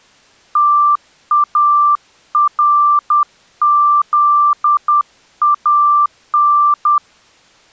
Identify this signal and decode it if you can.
Morse code (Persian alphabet), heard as a keyed tone, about 10 wpm, 1180 Hz. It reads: تارزان